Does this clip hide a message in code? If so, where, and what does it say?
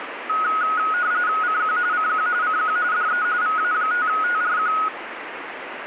Yes: RTTY (45.45 baud, 170 Hz shift) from 0.3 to 4.9 s, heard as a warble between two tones, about 1360 Hz centre, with radio static. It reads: CQ CQ CQ DE VA5TRQ